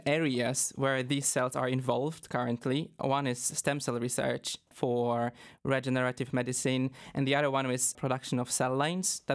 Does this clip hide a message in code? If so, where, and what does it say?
No, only speech in English.